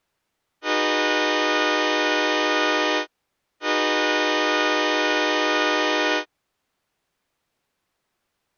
Train horn signal, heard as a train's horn. 2 long. On North American railways: brakes released, proceed.